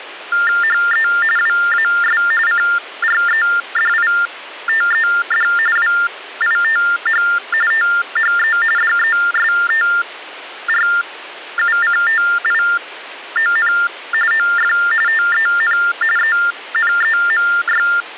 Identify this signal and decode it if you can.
TTY/TDD text telephone tones (45.45 baud Baudot), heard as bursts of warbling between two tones, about 400 Hz shift, 1600 Hz centre, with phone line noise. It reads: HE WAS CREDITED WITH THE DESTRUCTION OF TEN ENEMY